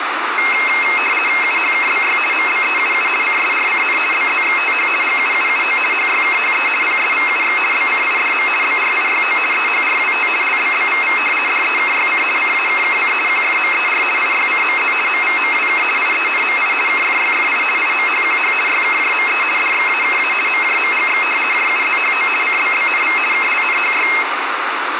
RTTY (50 baud, 450 Hz shift), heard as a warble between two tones, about 2350 Hz centre, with radio static. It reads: UHKBY MBEUU CSRCN BZXTH GUUUO HYKHE PSVUX BCIDM BRIYO EHRWT LBBVV DEKYC CAKKC QFMER IYCMZ MVMWK IENMI KFYFI IMHQH YKJME DXAKA MJMGX JUZHO CBBNV KLNHY